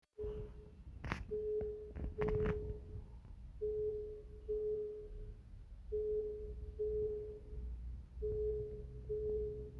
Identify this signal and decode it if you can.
The noise inside a lift. There is no code.